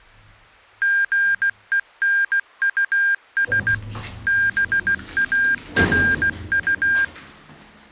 Morse code, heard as electronic beeps, machine-sent, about 16 wpm, 1600 Hz, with the noise inside a lift. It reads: GENUS BARU